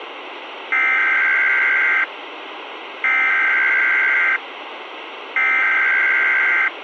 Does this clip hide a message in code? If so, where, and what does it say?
Yes: Emergency Alert System (SAME) tones (header bursts) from 0.7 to 6.7 s, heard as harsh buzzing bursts, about 520.83 baud, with radio hiss.